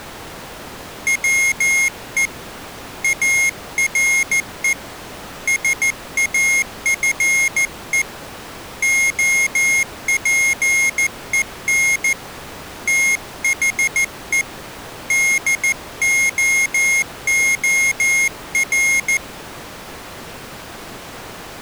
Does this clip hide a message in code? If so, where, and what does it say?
Yes: Morse code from 1.0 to 19.2 s, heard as a high beeper, hand-sent with a paddle, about 14 wpm, 2150 Hz. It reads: WE ARE SAFE OPEN THE DOOR